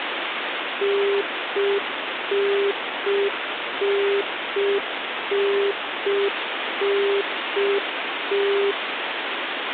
Telephone call progress tone (UK plan), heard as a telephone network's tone, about 400 Hz, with phone line noise. Congestion tone.